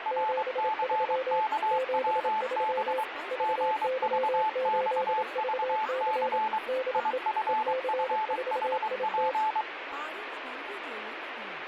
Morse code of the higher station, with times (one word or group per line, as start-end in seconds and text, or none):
0.1-3.0 RCKWB
3.4-6.6 GVXVC
6.9-9.6 IFFHP